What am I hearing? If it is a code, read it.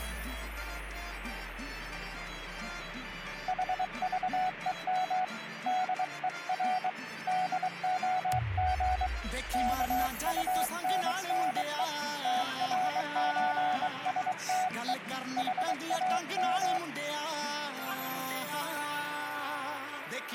Morse code (with Danish letters), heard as a keyed tone, hand-sent with a bug key, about 23 wpm, 740 Hz, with radio static. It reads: HVEM DER DOG KUNNE TRØSTE HAM